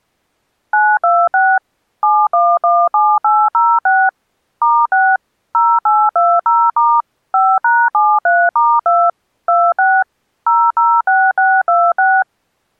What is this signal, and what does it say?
DTMF, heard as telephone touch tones, dialled by machine, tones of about 240 ms. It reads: 926 7117806 *6 0820* 5#73*2 26 006626